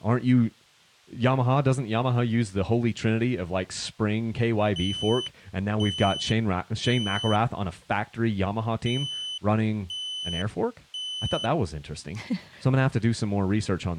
Alarm pattern, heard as an alarm's beeps, played twice, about 3000 Hz, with speech in English. Temporal three. Smoke or fire, evacuate.